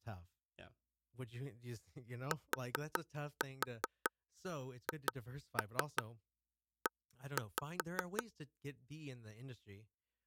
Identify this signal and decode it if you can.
Tap code, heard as taps on a table, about 5 knocks a second, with speech in English. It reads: THE